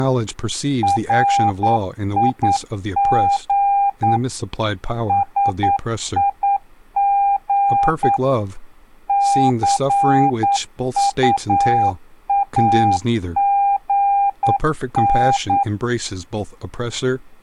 Morse code, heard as a keyed tone, machine-sent, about 9 wpm, 800 Hz, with speech in English. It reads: RIG SIG CUAGN